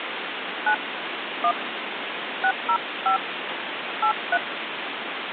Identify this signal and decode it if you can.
DTMF, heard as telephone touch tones, dialled by hand, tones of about 90 ms, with phone line noise. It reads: 9 1 605 83